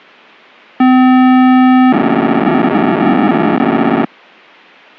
POCSAG pager data (512 baud), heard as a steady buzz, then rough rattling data.